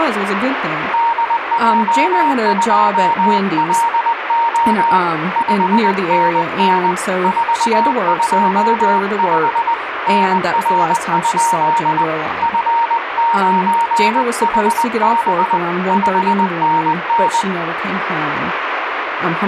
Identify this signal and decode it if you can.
Morse code, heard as a keyed tone, hand-sent with a paddle, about 20 wpm, 930 Hz, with radio static and speech in English. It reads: DJ2LO 5NN 425 NR? F9HB 5NN